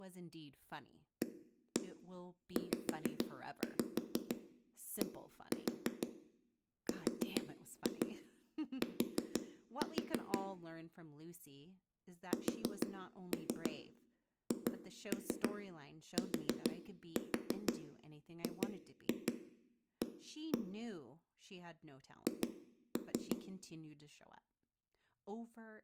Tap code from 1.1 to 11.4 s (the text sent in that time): AZDRT